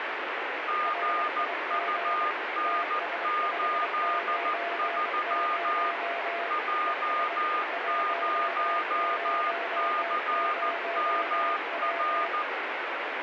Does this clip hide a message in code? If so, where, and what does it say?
Yes: Morse code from 0.6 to 12.5 s, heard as two keyed tones, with heavy radio static. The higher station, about 14 wpm, 1220 Hz: GUN83 J0CMR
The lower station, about 24 wpm, 680 Hz: RIG TS590 ES 100W